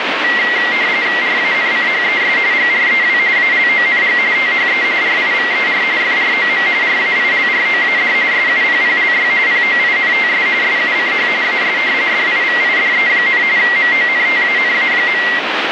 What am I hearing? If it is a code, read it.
RTTY (45.45 baud, 170 Hz shift), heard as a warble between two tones, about 2000 Hz centre, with radio static. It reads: RANCHES GREW ALONG THE RIVER FROM RAILROAD SUPPLY POINTS SUCH AS DIVIDE, MONTANA.